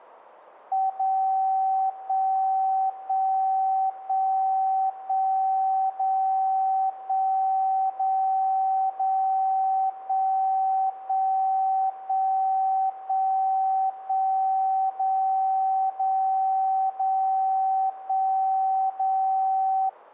Radio time signal (DCF77), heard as a tone whose level steps once a second, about 770 Hz. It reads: 0 1 1 1 1 0 1 0 0 1 1 1 1 1 0 0 0 1 0